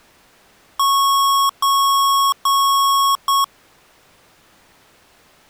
Beep code, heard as beeps from a small speaker, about 1100 Hz. 3 long, 1 short.